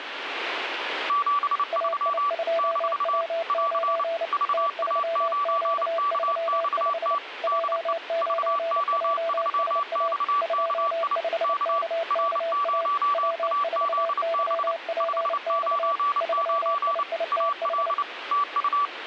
Morse code, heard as two keyed tones, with radio static. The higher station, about 29 wpm, 1150 Hz: 73 - <AR> VA9KXT DE VO3XKI K R0AZB 599 AL TU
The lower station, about 29 wpm, 670 Hz: AI2W9 T3Q35 J9JSA 25KKA W4YPX 3IITH